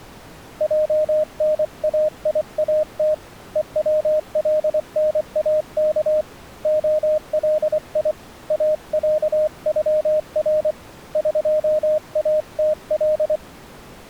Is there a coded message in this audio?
Yes: Morse code (Persian alphabet) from 0.5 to 13.4 s, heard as a keyed tone, hand-sent with a paddle, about 24 wpm, 620 Hz. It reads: جنایات هولناک علی اصغر قاتل